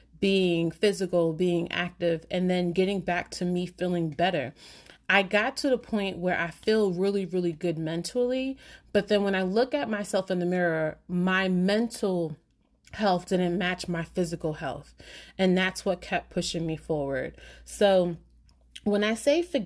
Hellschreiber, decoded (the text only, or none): none